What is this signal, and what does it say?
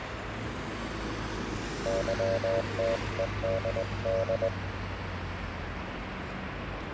Morse code, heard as a keyed tone, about 19 wpm, 570 Hz, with radio static, a weaker station near 1160 Hz and street noise. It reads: YTEDD